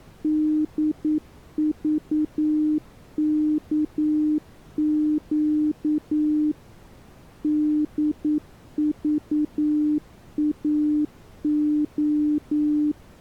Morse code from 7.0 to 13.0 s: DVAO

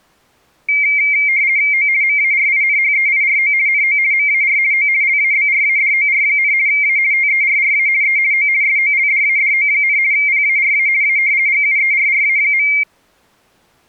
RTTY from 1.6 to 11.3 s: O MARINHEIRO NO MAR O LABRADOR, A TERRA E O SOLDADO, PARA A

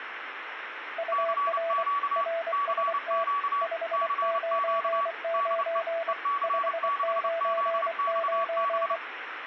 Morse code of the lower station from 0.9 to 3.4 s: UR RST

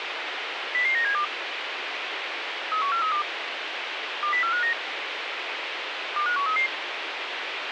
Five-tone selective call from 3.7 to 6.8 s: 20459 25133

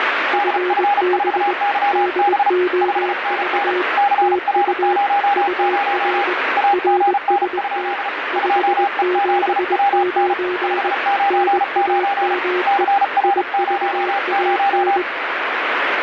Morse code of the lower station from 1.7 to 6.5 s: DOV TU UR

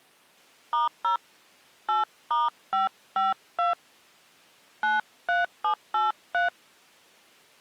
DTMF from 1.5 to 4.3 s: 8*552

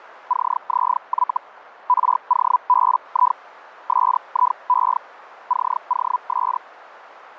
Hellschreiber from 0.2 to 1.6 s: CZY

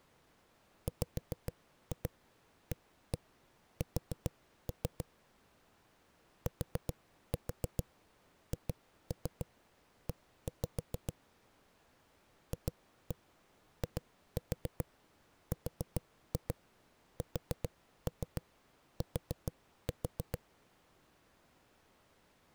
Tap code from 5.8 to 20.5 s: THE FIRST

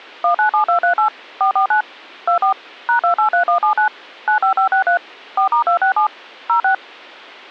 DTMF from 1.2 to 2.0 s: 449

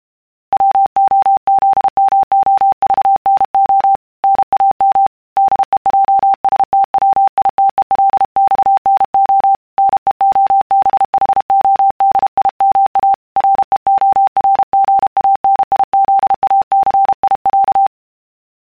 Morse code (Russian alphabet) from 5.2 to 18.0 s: ДЕЙСТВИТЕЛЬНО НЕОБХОДИМА РЕОРГАНИЗАЦИЯ

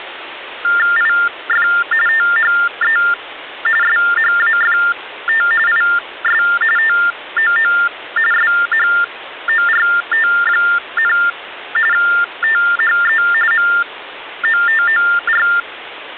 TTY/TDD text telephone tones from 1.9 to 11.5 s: THE SHAFT IS TOO SHORT,

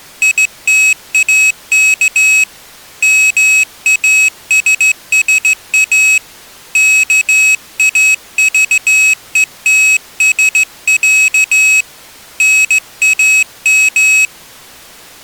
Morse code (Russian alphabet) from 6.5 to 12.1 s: КАЖЕТСЯ

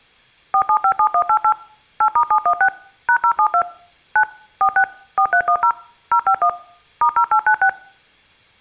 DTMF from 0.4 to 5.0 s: 4757188 8*716 #072 9 46

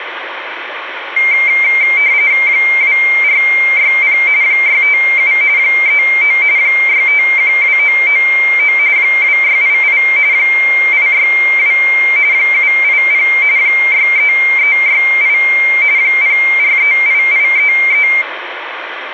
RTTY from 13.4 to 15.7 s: 63368

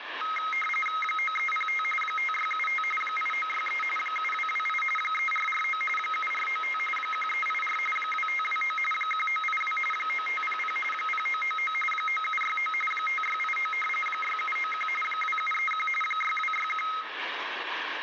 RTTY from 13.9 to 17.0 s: 6791 2731 6261

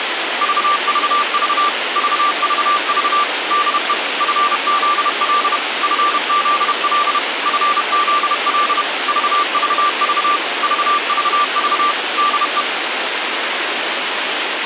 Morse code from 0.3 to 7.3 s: VVV VVV DE FZL FZL

